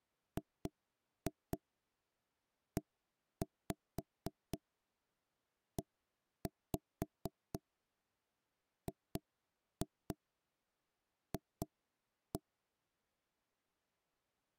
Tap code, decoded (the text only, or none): GEEGF